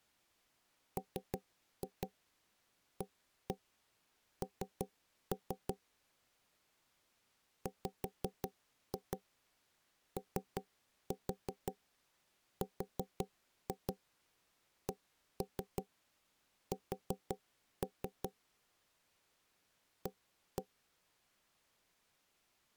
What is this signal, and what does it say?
Tap code, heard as knocks on wood, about 5 knocks a second. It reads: MAN WORKS A